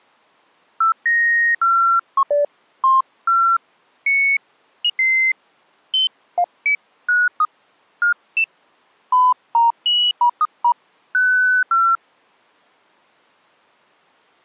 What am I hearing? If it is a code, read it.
Electronic bleeps of random pitch and length. There is no code.